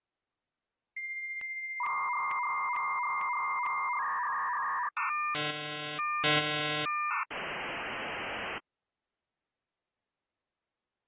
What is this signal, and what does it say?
Dial-up modem handshake (V.34 or later), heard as a whistle, warbles, then hiss.